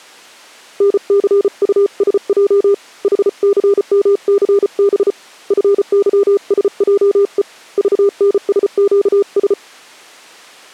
Morse code, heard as a keyed tone, hand-sent with a paddle, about 34 wpm, 400 Hz. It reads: NCUSJ HCMCB FYSJE VNSQS